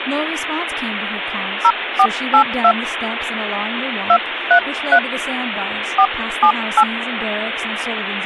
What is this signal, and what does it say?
DTMF, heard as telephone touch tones, dialled by hand, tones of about 70 ms, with phone line noise and speech in English. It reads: 0482 233 478